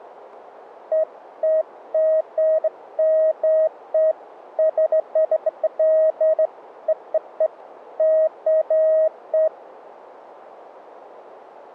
Beeps of irregular length, with radio static. There is no code.